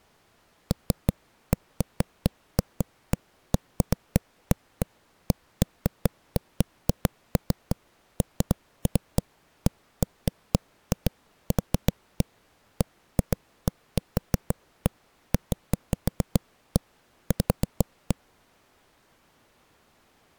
Irregular knocks on a wall. There is no code.